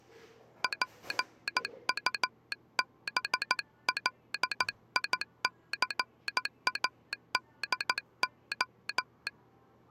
Morse code, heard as a telegraph sounder, hand-sent with a paddle, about 14 wpm, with the noise of a cafe. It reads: PUBLICADO